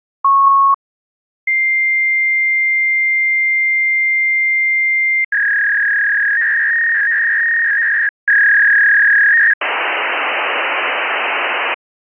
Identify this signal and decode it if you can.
Fax machine handshake, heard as a beep, a long tone, a warble and hiss.